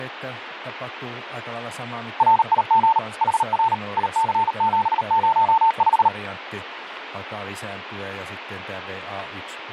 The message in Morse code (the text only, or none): RIG HR IC705